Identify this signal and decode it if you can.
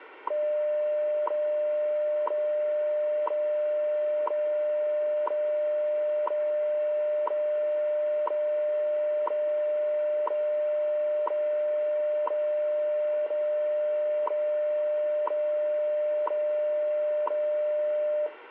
Radio time signal (WWV, Colorado), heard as ticks, one a second, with radio static.